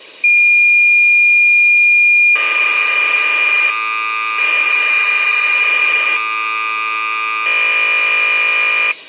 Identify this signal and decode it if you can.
Cassette data (Kansas City type), 1200 baud, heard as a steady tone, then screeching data.